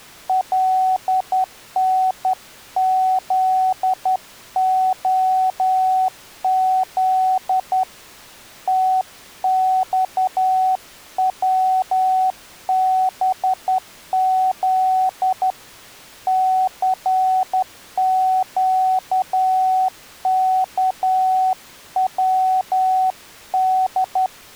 Morse code, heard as a keyed tone, hand-sent with a straight key, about 11 wpm, 750 Hz. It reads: LNZOZ TXWBZ CQKWD